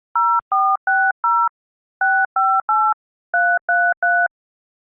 DTMF, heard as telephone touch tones, dialled by hand, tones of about 240 ms. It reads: 0460 658 333